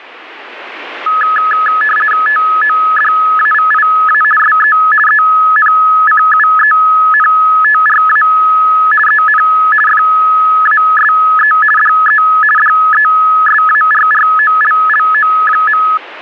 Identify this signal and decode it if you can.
RTTY (50 baud, 450 Hz shift), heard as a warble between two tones, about 1490 Hz centre, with radio static. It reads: TODAVIA SE ENCUENTRA EN FASE DE DESARROLLO.